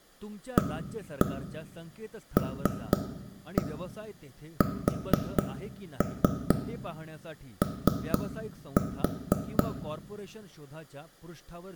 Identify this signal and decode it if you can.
Tap code, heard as taps on a table, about 4 knocks a second, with room echo and speech in Marathi. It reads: ALSO